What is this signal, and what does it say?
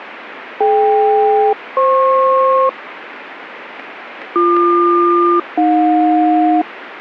Aircraft SELCAL, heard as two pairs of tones, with radio static. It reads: DK-FP BQ-AJ